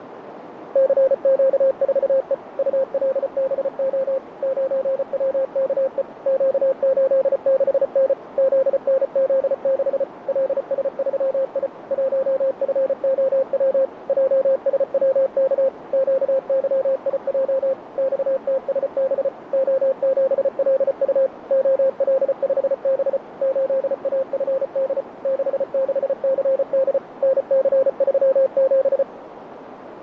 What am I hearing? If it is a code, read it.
Morse code, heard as a keyed tone, machine-sent, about 34 wpm, 530 Hz, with radio static and a narrow filter. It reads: CQ4E ULBO 9WKE Q86N ZNZ6 LS3I 1FOW JSWK QYIJ XTSB O7LU OL5B 8AFD 66CD NC37